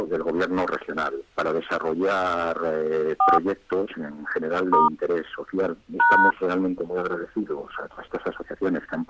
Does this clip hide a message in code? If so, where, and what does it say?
Yes: DTMF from 3.2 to 6.3 s, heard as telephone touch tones, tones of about 230 ms. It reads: 4 * #